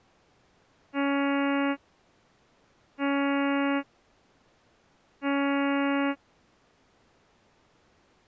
Ship horn signal, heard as a ship's horn, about 280 Hz. 3 short. At sea: I am operating astern propulsion.